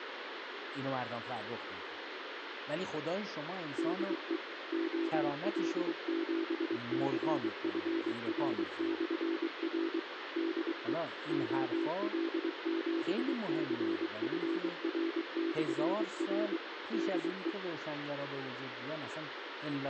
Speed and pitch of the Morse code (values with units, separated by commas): 23 wpm, 330 Hz